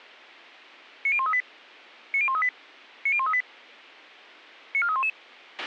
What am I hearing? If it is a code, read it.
Five-tone selective call (ZVEI), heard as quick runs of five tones, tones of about 70 ms, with a squelch burst at the end. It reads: 90138 90138 90138 94311